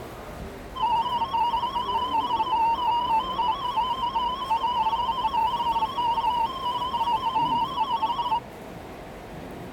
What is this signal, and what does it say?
Multi-tone FSK (Olivia or MFSK type), about 250 Hz wide, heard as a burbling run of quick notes, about 31.25 baud, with the noise of a subway station.